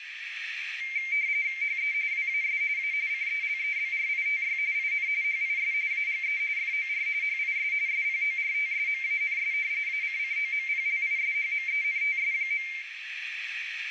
RTTY (45.45 baud, 170 Hz shift), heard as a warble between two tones, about 2200 Hz centre, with radio static, a narrow filter and room echo. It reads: HE WAS A CELEBRITY IN HIS AGE FOR HIS SPORTSMANS ACCOMPLISHMENTS.